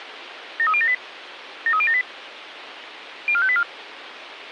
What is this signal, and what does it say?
Five-tone selective call (ZVEI), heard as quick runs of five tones, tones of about 70 ms, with radio hiss and a squelch burst at the end. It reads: 73078 73078 04584